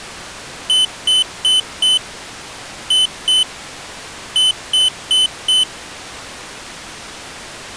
Beep code, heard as a piezo beeper, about 3050 Hz. 4-2-4. In Phoenix BIOS tables: unexpected interrupt in protected mode.